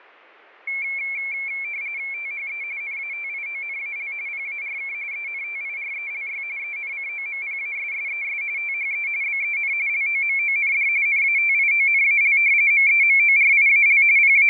RTTY (45.45 baud, 170 Hz shift), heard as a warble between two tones, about 2250 Hz centre, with fading. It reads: THE NATIONAL PARK ENTIRELY ENCOMPASSES THE BEN LOMOND NATIONAL MEMORIAL …